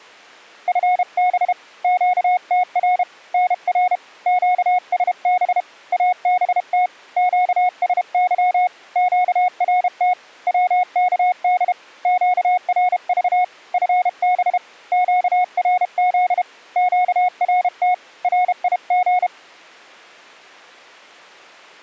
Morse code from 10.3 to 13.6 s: WKD QRV

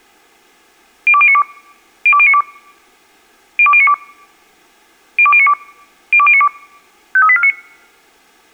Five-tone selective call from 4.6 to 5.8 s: 02092

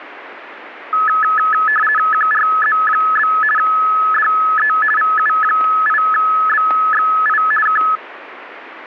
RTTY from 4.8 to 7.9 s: VU8BXI K

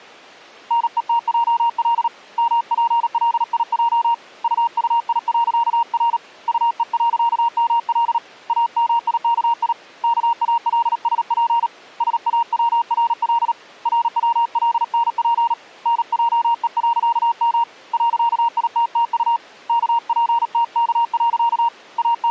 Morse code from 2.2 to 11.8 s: MPLIJ UUI.R UE.ML AMIKI KALSP

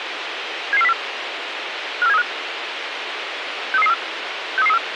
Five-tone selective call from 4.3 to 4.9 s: 63334

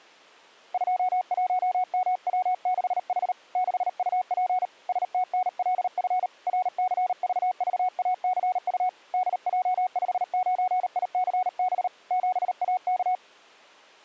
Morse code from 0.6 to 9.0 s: 21MW6H 6UP STNLF RCVVACU

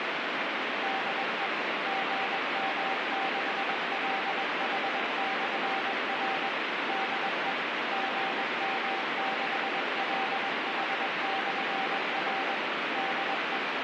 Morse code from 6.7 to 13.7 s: DE GM6LH/R DE

